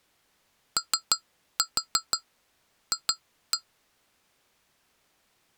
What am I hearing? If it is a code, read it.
Tap code, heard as taps on glass, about 6 knocks a second. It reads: OF